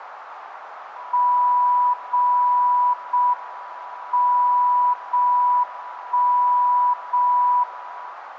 Radio time signal (JJY), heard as a tone whose level steps once a second, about 980 Hz, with radio static. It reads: 0 0 M 0 1 0 1